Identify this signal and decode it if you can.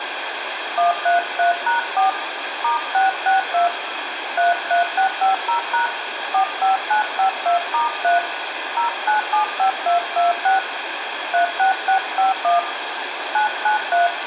DTMF, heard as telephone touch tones, dialled by hand, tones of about 120 ms, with phone line noise and room echo. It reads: 133#4 *662 33650# 45952*3 0975226 36651 993